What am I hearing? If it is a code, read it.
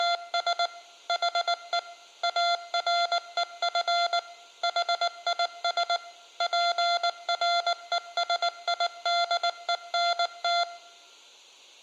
Morse code, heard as electronic beeps, machine-sent, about 19 wpm, 690 Hz, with room echo. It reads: … HE AREF HIS PRESIDENT